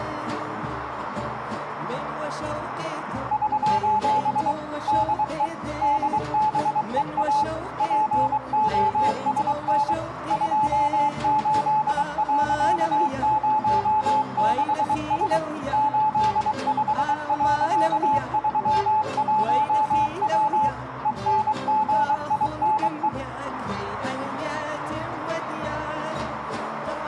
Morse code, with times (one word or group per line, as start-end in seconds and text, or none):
3.3-4.5 <SOS>
4.9-5.5 DE
5.8-7.4 DBEA
7.8-9.9 POSN
10.3-15.4 28.06S
15.7-20.7 85.31W
21.1-23.1 ENGINE